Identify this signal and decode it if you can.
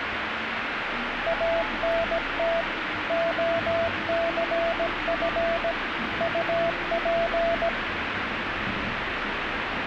Morse code, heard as a keyed tone, machine-sent, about 17 wpm, 670 Hz, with radio static and the noise inside a subway train. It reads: ANT OCF UP